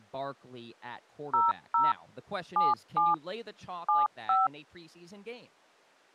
DTMF, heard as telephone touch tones, dialled by machine, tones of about 180 ms, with speech in English. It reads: 00 77 75